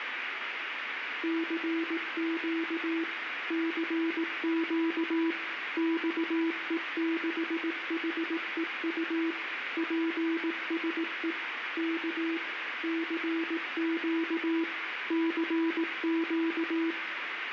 Morse code, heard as a keyed tone, machine-sent, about 18 wpm, 330 Hz, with radio static and room echo. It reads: CQ CQ XE6HEU PSE K CQ CQ